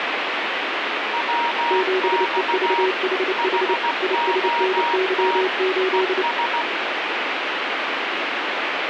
Morse code, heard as two keyed tones, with heavy radio static. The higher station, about 16 wpm, 940 Hz: WX HOT ES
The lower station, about 29 wpm, 380 Hz: 7EVHH ISNY8